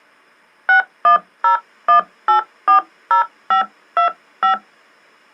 DTMF, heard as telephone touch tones, dialled by hand, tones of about 110 ms. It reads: 6101840525